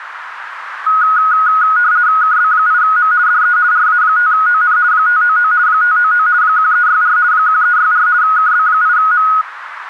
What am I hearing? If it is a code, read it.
RTTY (50 baud, 170 Hz shift), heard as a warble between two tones, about 1360 Hz centre, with radio static. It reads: KB8M DE RA5ON 599 599 1364 1364 KB8M